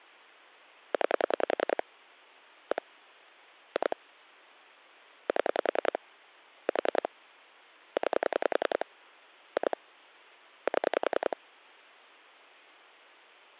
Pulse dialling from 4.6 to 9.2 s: 7 4 9

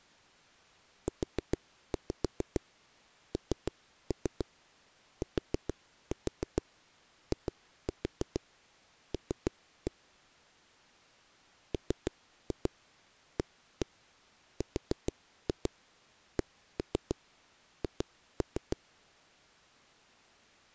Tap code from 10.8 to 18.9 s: MARCH

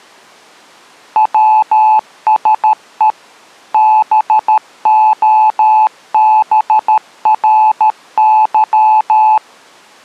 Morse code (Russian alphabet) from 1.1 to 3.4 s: ВСЕ

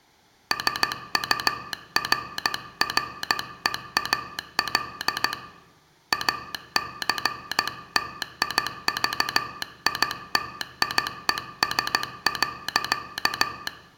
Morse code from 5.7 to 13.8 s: ACTIVITIES.

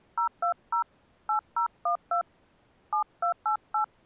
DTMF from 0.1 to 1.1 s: 020

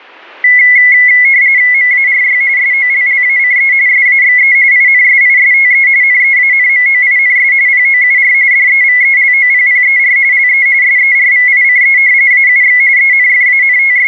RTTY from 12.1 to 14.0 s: AUX …

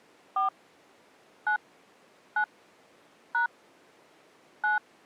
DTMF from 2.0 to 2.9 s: 9

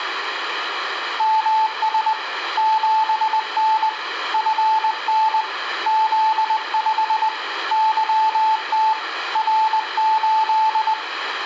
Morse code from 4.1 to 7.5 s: FN Z5

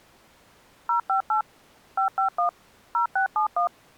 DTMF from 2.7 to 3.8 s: 0671

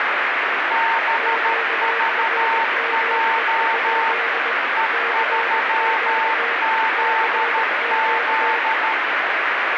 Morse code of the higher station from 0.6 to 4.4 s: BVJ

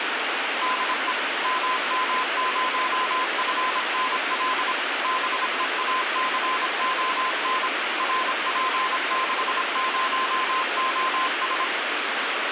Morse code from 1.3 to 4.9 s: MM0FNL

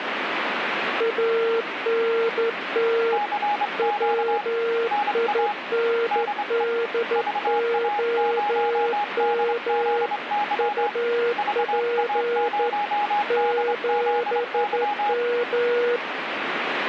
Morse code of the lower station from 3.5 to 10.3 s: WINDOM

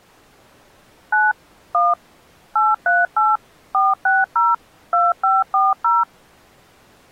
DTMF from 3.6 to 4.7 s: 460

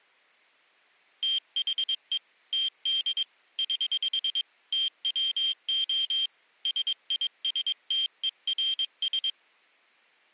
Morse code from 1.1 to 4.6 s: THE TD <HH>

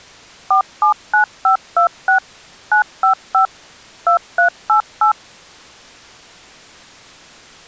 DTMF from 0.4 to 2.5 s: 479526

